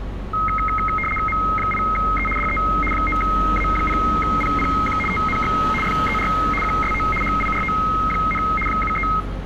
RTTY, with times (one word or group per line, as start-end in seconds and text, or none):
1.3-2.3 M8E
2.4-2.6 DE
2.9-5.0 9A0PPQ
5.1-5.5 TNX
5.8-6.3 FER
6.6-7.0 QSO
7.2-8.4 HIRO,
8.7-9.1 73